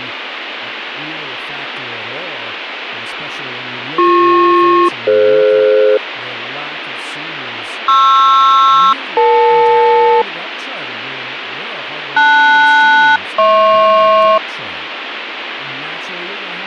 Aircraft SELCAL, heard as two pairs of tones, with radio static and speech in English. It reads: BP-DF PR-EL LS-HP